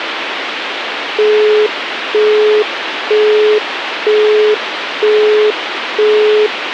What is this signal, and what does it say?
Telephone call progress tone (single-tone plan, as in Europe, Japan and elsewhere), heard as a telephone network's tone, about 420 Hz, 0.48 s on and 0.48 s off, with phone line noise. Busy tone.